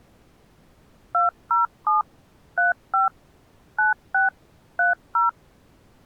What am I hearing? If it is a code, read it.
DTMF, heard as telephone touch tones, dialled by machine, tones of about 140 ms. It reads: 207 35 96 30